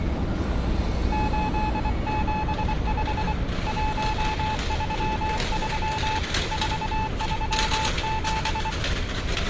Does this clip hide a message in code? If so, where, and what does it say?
Yes: Morse code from 1.1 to 8.8 s, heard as a keyed tone, hand-sent with a paddle, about 24 wpm, 870 Hz, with street noise. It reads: 875 133 437